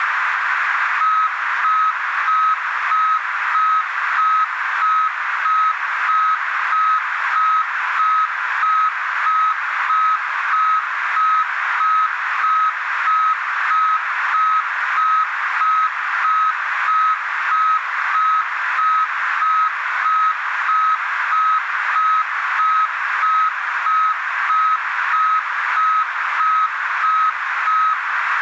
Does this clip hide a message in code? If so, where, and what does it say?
No, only evenly repeated beeps, with radio static and a narrow filter.